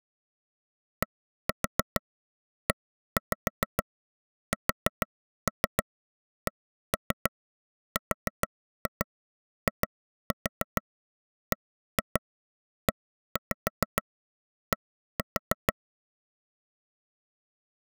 Tap code, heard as taps on a table, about 6 knocks a second. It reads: DESCRIBED